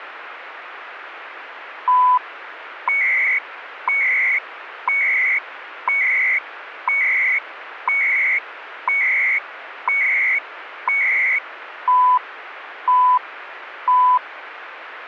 Radio time signal (CHU, Canada), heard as beeps and data bursts, one a second, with radio static.